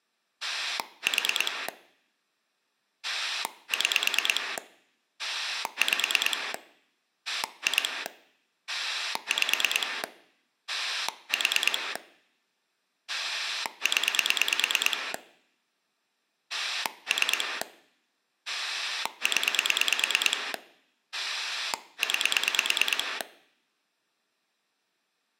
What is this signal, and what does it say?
Pulse dialling, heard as a rotary dial, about 9 pulses a second. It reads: 4 6 5 2 5 4 0 3 0 9